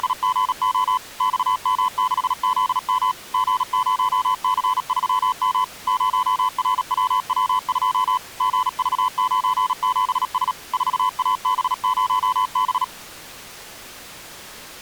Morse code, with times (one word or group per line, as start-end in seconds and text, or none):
0.0-1.0 …
1.2-3.1 XM6ZM
3.3-5.6 G0C3M
5.9-8.2 0RWW2
8.4-10.5 GV97S
10.7-12.8 4AB0B